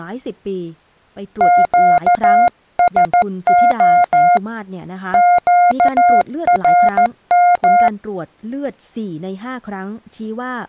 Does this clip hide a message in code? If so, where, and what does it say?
Yes: Morse code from 1.3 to 7.9 s, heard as a keyed tone, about 14 wpm, 710 Hz, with speech in Thai. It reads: QSO QRM